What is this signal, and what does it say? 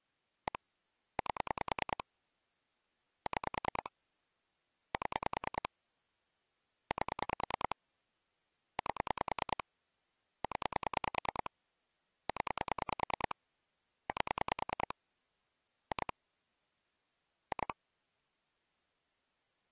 Pulse dialling, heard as clicks on a phone line, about 10 pulses a second. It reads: 1 8 6 7 8 8 0 0 8 2 2